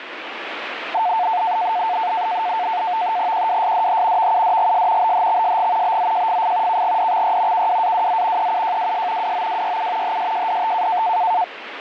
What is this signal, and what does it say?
NAVTEX (SITOR-B), 100 baud, 170 Hz shift, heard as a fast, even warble, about 800 Hz centre, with radio static. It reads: QWSDH VUDGS BHXSG BZJFF KGDXY KWAWZ EUJWS WOWYU HSJDT